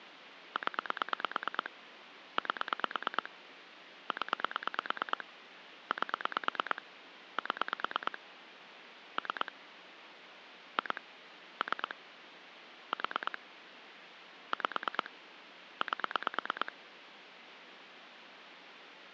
Pulse dialling, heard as clicks on a phone line, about 9 pulses a second, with phone line noise. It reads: 0 8 0 8 7 3 2 3 4 5 8